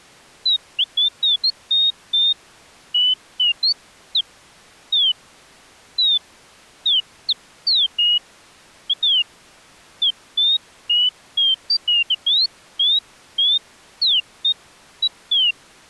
Bird-like chirps. There is no code.